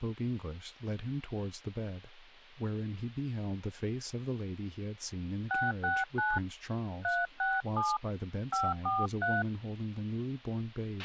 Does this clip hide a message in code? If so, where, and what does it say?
Yes: DTMF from 5.5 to 9.4 s, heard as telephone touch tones, dialled by hand, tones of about 200 ms, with a squelch burst at the end and speech in English. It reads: 669 367 543